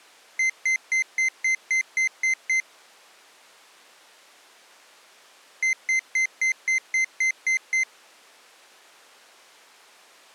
Beep code, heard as a piezo beeper, played twice, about 2050 Hz. 9 short. In AMI BIOS tables: ROM checksum failure.